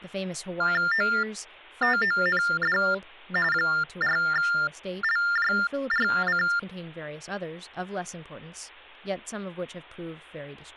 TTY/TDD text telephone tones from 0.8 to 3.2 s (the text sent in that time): OTOND